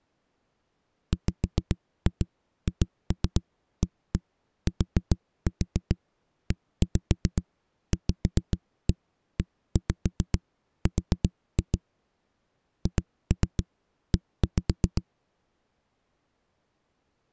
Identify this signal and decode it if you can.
Tap code, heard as knocks on a wall, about 7 knocks a second. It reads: WHATEVER HE